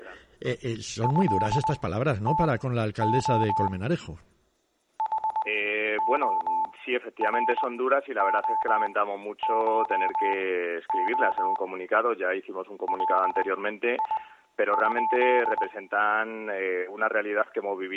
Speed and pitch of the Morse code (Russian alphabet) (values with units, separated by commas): 20 wpm, spaced as for 11 wpm, 880 Hz